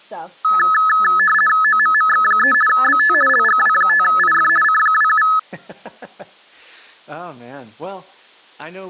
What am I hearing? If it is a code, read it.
RTTY (50 baud, 450 Hz shift), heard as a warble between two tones, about 1500 Hz centre, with speech in English. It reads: OMMX3 BT LGW5IF C27